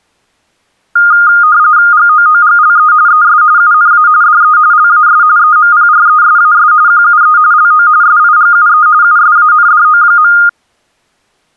RTTY (45.45 baud, 170 Hz shift), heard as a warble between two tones, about 1320 Hz centre. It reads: GOOGLE ES UNA DE LAS EMPRESAS QUE LO SIGUE USANDO.